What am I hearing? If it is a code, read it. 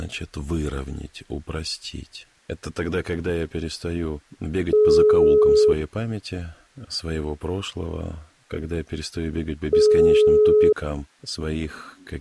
Telephone call progress tone (single-tone plan, as in most of Europe), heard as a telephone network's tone, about 420 Hz, 1 s on and 4 s off. Ringback tone.